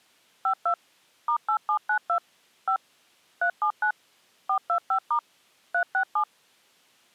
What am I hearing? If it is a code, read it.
DTMF, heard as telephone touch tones, dialled by machine, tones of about 90 ms. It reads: 52 *8792 5 379 425* 367